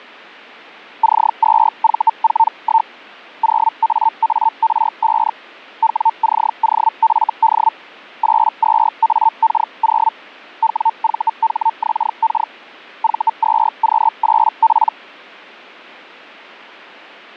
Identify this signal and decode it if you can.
Hellschreiber (Feld-Hell, 122.5 baud), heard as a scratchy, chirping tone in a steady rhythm, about 900 Hz. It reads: C2V41 0AAR5 WCOFD 82AK0 WVHXK V2Q8P